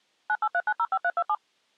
DTMF, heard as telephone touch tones, dialled by machine, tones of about 60 ms. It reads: 983905327